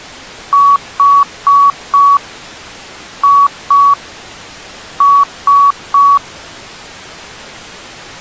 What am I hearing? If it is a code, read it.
Beep code, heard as beeps, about 1130 Hz. 4-2-3. In Phoenix BIOS tables: gate A20 failure.